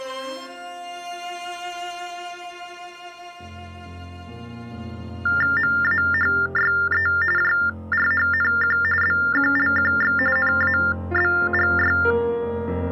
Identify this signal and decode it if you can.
TTY/TDD text telephone tones (45.45 baud Baudot), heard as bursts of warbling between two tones, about 400 Hz shift, 1600 Hz centre. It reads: MAHYE JRHNQ BQLQX NABGY